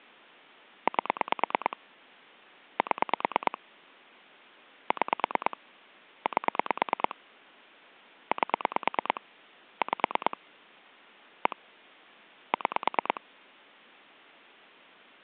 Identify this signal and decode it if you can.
Pulse dialling, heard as clicks on a phone line, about 9 pulses a second. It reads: 8 7 6 8 8 5 1 6